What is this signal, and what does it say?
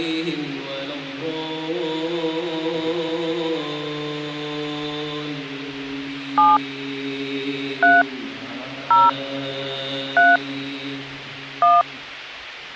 DTMF, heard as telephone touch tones, dialled by hand, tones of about 190 ms. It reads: 7 3 0 3 1